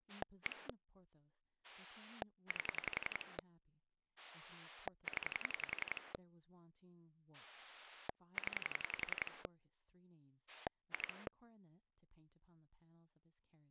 Pulse dialling, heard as a rotary dial, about 11 pulses a second, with speech in English. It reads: 1 8 0 0 2